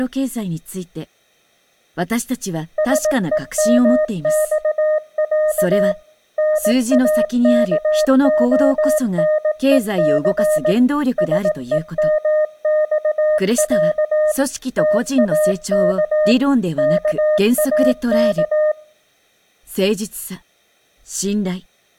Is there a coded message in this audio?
Yes: Morse code (Russian alphabet) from 2.7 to 18.8 s, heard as a keyed tone, machine-sent, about 18 wpm, 610 Hz. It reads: СЕМЬЯ НАКОНЕЦ СЕМЬЯ ТАК КАК